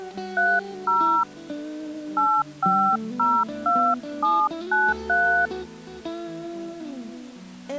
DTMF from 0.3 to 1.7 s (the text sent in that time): 30